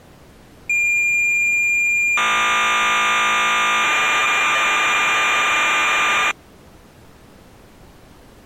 Cassette data (Kansas City type), 1200 baud, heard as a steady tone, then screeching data.